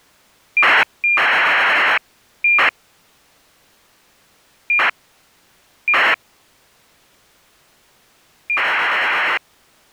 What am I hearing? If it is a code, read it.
ACARS aircraft data, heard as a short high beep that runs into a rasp, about 2400 baud.